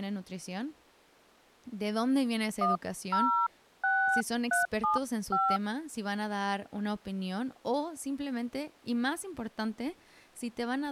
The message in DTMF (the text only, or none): 106375